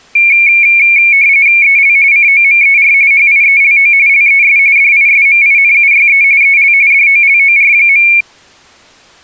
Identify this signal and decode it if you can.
RTTY (45.45 baud, 170 Hz shift), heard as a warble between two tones, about 2300 Hz centre. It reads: EL COMER HIELO LES DISMINUYE EL DOLOR.